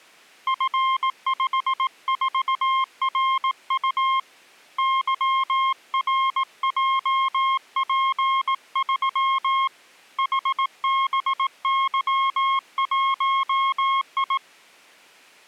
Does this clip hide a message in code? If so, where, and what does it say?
Yes: Morse code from 0.4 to 14.4 s, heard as a keyed tone, hand-sent with a paddle, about 18 wpm, 1070 Hz. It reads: F54RU YRJP3 HBY1I